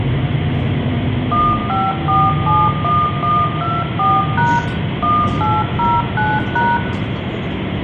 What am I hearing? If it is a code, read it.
DTMF, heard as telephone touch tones, dialled by machine, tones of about 220 ms, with phone line noise, room echo and the noise inside a bus. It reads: 15471124# 1809#